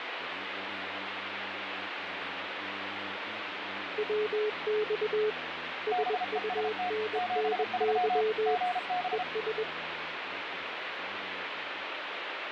Morse code, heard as two keyed tones, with radio static. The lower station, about 21 wpm, 430 Hz: WX SUNNY ES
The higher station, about 33 wpm, 720 Hz: BEST 73 GB